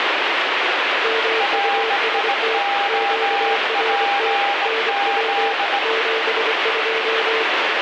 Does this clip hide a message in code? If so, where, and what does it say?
Yes: Morse code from 1.0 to 7.5 s, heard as two keyed tones, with heavy radio static. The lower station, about 24 wpm, 450 Hz: MUST QRT NW 72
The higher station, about 18 wpm, 800 Hz: RIOPZ